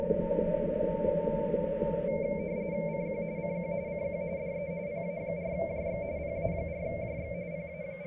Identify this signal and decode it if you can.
RTTY (45.45 baud, 170 Hz shift), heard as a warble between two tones, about 2250 Hz centre, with radio static. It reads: CQ CQ CQ DE PA4JX PA4JX …